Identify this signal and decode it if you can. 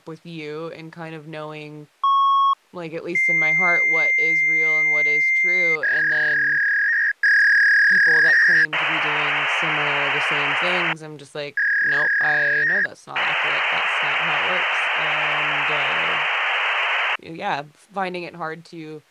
Fax machine handshake, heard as a beep, a long tone, a warble and hiss, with speech in English.